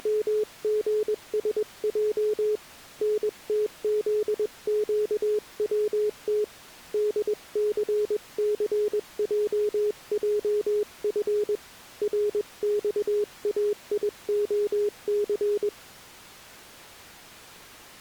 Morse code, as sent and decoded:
… / -. - --.. --.- .-- - / -.. -.-. -.-. .--- .--- ..-. / .-. -..- .- .. --- -.-.
… NTZQWT DCCJJF RXAIOC

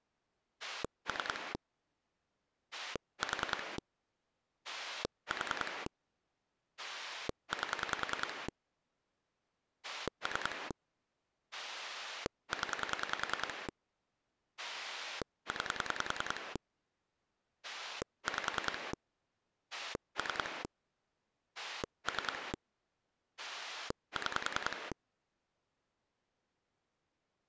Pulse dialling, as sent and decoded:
3 / 4 / 4 / 8 / 3 / 10 / 9 / 5 / 3 / 3 / 6
3 4 4 8 3 0 9 5 3 3 6

